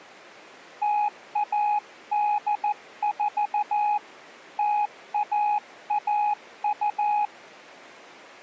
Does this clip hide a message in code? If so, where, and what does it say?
Yes: Morse code (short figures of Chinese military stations) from 0.8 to 7.3 s, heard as a keyed tone, hand-sent with a paddle, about 14 wpm, 830 Hz. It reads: 0184 0112